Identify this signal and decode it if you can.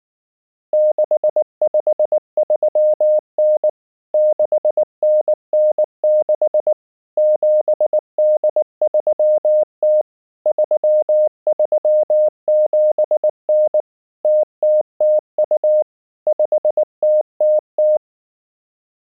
Morse code (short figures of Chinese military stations), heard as a keyed tone, machine-sent, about 19 wpm, 610 Hz. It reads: 6539 6996 7830 3379 0002 5000